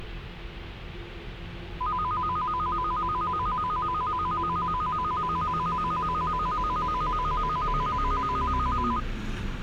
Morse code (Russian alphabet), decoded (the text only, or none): none